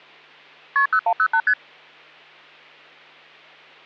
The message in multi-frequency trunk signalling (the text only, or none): KP 0108 ST